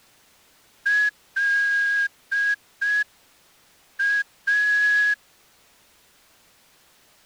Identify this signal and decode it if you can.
Morse code, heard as a whistle, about 5 wpm. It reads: LA